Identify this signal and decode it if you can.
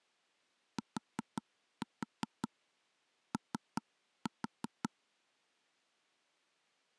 Tap code, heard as taps on a table, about 5 knocks a second. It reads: TO